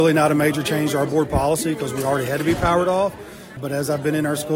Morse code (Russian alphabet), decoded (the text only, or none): none